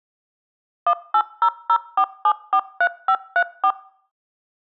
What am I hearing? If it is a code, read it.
DTMF, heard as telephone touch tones, dialled by machine, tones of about 70 ms. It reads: 18004743534